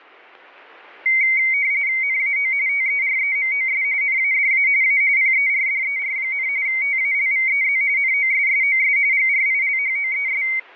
RTTY (45.45 baud, 170 Hz shift), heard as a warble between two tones, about 2150 Hz centre, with static crashes. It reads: NAO TEREMOS NADA A PERDER, TALVEZ NOSSOS GRILHOES